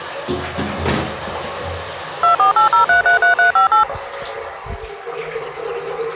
DTMF, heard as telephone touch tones, dialled by machine, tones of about 120 ms, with the noise of a restroom. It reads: 2480333358